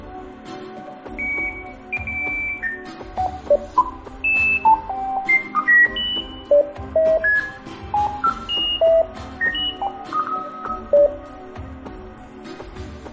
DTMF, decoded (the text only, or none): none